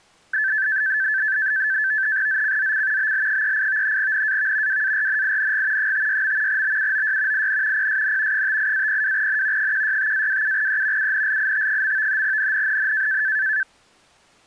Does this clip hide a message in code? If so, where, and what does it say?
Yes: NAVTEX (SITOR-B), 100 baud, 170 Hz shift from 0.3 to 13.6 s, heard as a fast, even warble, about 1650 Hz centre. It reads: ZCZC BL38 NAV WARNING 56. BUOY IN PSN 58-02N 165-27E UNLIT. NNNN